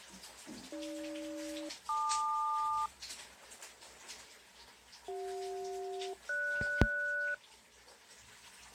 Aircraft SELCAL, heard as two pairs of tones, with the noise of a restroom. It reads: AG-LQ CJ-GS